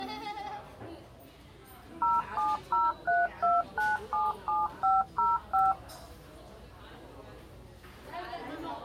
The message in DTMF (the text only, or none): 07032977505